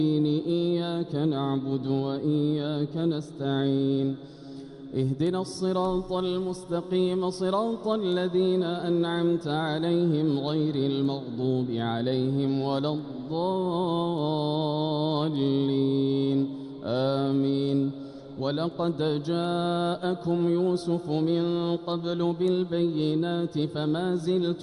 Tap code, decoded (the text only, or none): none